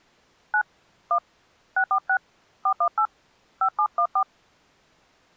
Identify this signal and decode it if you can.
DTMF, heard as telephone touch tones, dialled by hand, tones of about 80 ms. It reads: 9 1 646 418 5714